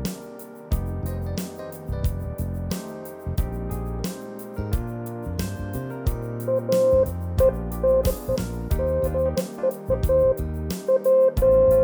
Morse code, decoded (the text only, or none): none